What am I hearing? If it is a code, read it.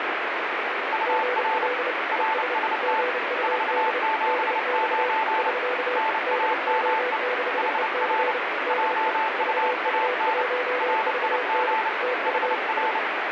Morse code, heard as two keyed tones, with heavy radio static. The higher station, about 29 wpm, 880 Hz: UR RST 479 NAME HR JUAN RIG HR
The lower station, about 30 wpm, 500 Hz: GL ES GUD DX <SK> DO6EC DE VU1VN TU E